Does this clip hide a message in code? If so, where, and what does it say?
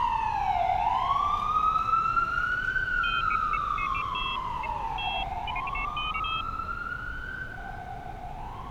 No, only pairs of high tones at irregular times, with street noise.